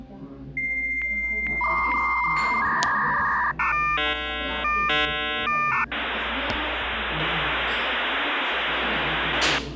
Dial-up modem handshake (V.34 or later), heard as a whistle, warbles, then hiss, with the noise of a crowd indoors.